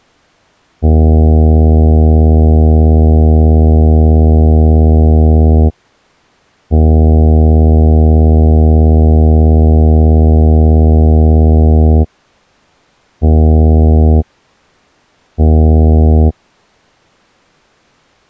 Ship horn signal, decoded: 2 long, 2 short

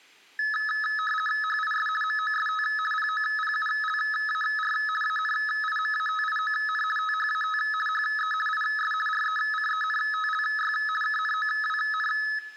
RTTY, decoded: HIS MOST POPULAR ANIMATION THAT HE IS RECENTLY KNOWN

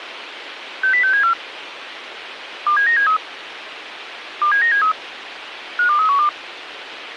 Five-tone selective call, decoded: 60674 27973 27973 52312

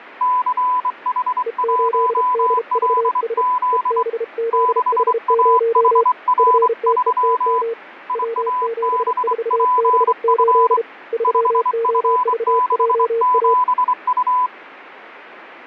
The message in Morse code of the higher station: CH1LZ 6AHR3 IABPF 5F67U

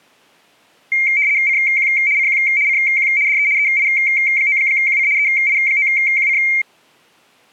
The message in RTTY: CQ CQ CQ DE EI9QC EI9QC

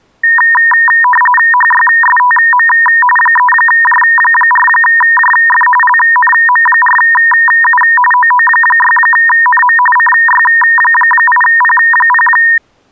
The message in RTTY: HYSTM 3J4JF LNM4U OO6NM CY8P0

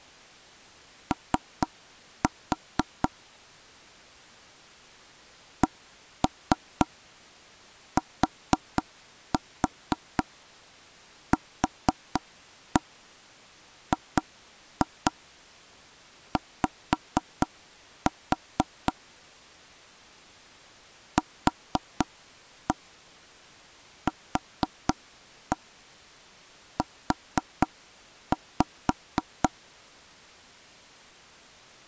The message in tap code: O CTQGY QQU

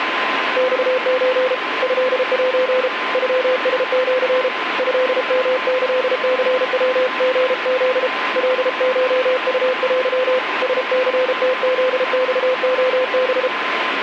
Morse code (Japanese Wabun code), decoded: マソ トセ ノラシ トヨキニヤリフ カコウテ ラニムフマレハ

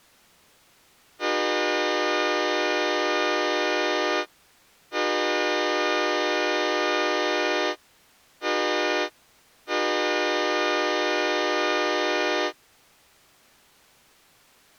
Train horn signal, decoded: 2 long, 1 short, 1 long

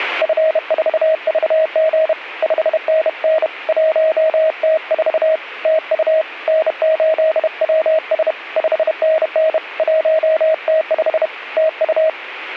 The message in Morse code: F4VG 5NN 1T4 TU N8WS 5NN 1T5 TU

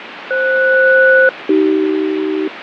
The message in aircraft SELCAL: FS-AC

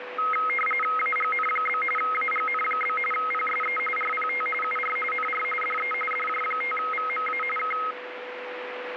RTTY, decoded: AGN? AGN? PSE RPT UR NR DE DJ5VMA K

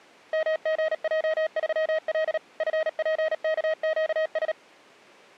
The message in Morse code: MGJ3L FPKQS

